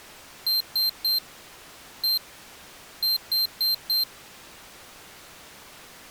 Beep code, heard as a piezo beeper, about 4150 Hz. 3-1-4. In Phoenix BIOS tables: interrupt mask register failure.